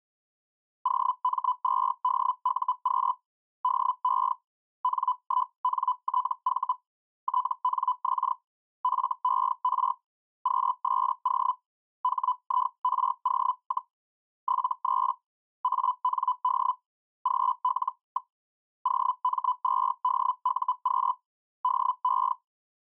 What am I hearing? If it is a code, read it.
Hellschreiber (Feld-Hell, 122.5 baud), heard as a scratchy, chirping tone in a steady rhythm, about 1000 Hz. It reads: OM2DUQ DE N1NTV TNX FER QSO HIRO, 73 AND GL. OM2DUQ DE